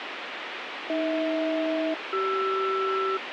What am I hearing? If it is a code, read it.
Aircraft SELCAL, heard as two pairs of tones, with radio hiss. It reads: AH-CR